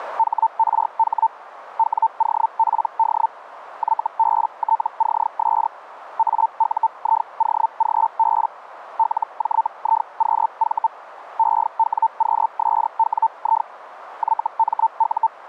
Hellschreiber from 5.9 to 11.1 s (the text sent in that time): AUIOGB LJIQV